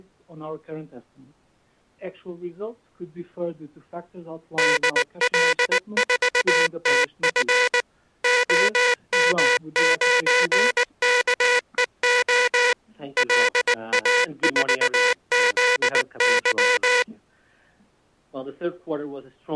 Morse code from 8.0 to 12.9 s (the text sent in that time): OM9KEO